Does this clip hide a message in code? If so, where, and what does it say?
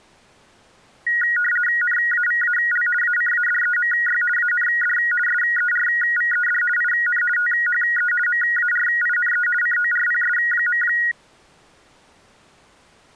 Yes: RTTY (50 baud, 450 Hz shift) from 1.1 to 11.1 s, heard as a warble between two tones, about 1650 Hz centre. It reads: NAVAL ACADEMY AND SERVED IN THE MARINE CORPS.